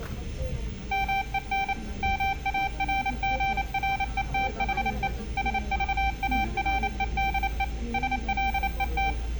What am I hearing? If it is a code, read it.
Morse code, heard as a keyed tone, machine-sent, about 28 wpm, 780 Hz, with room echo and the noise inside a bus. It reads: MEN MARGRETHE SVAREDE SLET